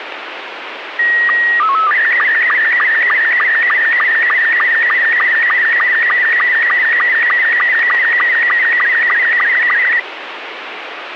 SSTV (slow-scan television), Robot 72, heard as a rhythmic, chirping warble, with radio static.